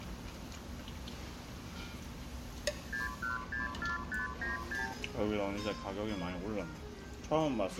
Multi-frequency trunk signalling (R2, with the far end's replies), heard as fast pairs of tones, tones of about 150 ms, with the noise of a restaurant. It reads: 6164596